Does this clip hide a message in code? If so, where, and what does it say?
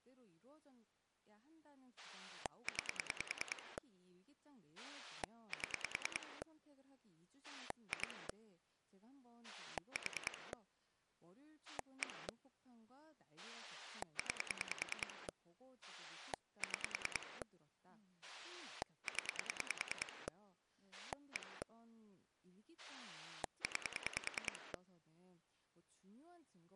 Yes: pulse dialling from 2.0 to 24.8 s, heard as a rotary dial, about 10 pulses a second, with speech in Korean. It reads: 9 7 2 4 1 9 6 0 1 9